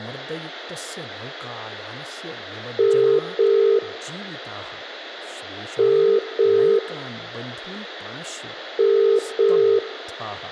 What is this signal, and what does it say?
Telephone call progress tone (as in the UK, Ireland, Australia and similar networks), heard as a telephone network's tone, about 400, 450 Hz, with room echo and speech in Sanskrit. Ringback tone.